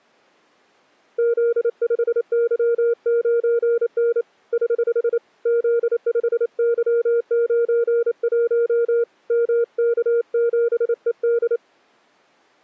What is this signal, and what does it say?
Morse code, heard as a keyed tone, hand-sent with a paddle, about 28 wpm, 470 Hz. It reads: Z5Y9N <HH> Z5Y91 MK7ED